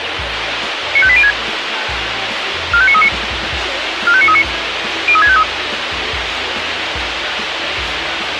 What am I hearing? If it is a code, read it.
Five-tone selective call (ZVEI), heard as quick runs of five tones, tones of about 70 ms, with radio hiss and a squelch burst at the end. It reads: 95806 45939 45939 03653